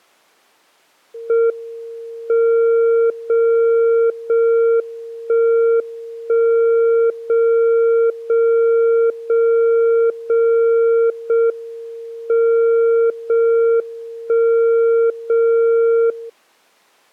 Radio time signal (JJY), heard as a tone whose level steps once a second, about 460 Hz. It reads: M 0 0 1 1 0 0 0 0 0 M 0 1 0 0